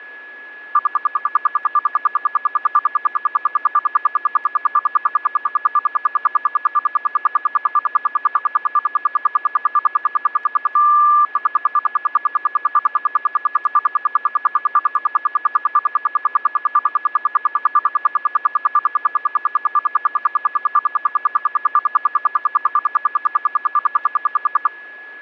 Radio time signal (RWM, Moscow), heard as ten pulses a second, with a steady whistle near 1700 Hz.